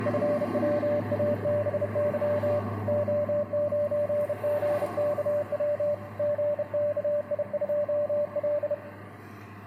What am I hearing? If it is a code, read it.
Morse code, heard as a keyed tone, hand-sent with a bug key, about 31 wpm, 590 Hz, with room echo and street noise. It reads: FWABY O9GKW GKI2L